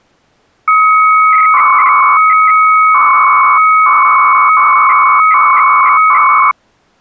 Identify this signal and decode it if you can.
300-baud modem data (Bell 103 tones), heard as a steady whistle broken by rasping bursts, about 300 baud, 200 Hz shift.